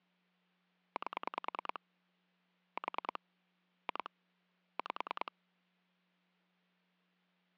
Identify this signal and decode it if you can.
Pulse dialling, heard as clicks on a phone line, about 10 pulses a second. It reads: 8 4 2 5